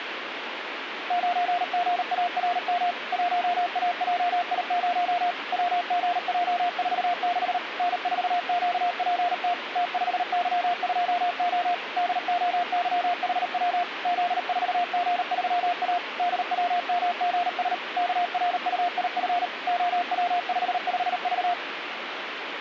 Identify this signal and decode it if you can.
Morse code, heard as a keyed tone, machine-sent, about 38 wpm, 710 Hz, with radio static. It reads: 9GARM 1AJI0 WGJ46 N4QPT T5Y2O DOYHW Z4G3A DWMGS KRUIF OW55V